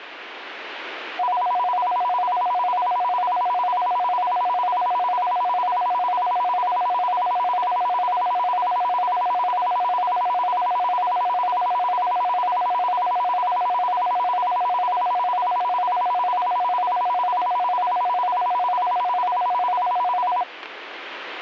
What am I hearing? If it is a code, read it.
A tone that alternates evenly between two pitches. There is no code.